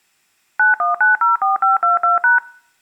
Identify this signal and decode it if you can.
DTMF, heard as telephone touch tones, dialled by machine, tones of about 140 ms. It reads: 91904522#